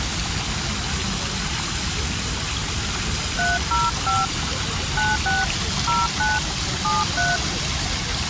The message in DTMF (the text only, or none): 305 96 09 73